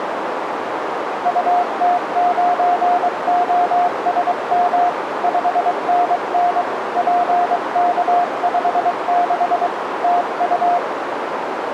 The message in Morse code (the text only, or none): UT9OSM 5NN PK56 TU